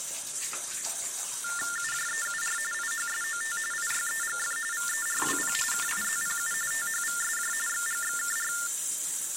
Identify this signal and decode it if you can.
TTY/TDD text telephone tones (45.45 baud Baudot), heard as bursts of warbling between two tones, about 400 Hz shift, 1600 Hz centre, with the noise of a restroom. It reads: UJEUR IHSOT IYEGF VERWP KIZPU THVSJ XGXKR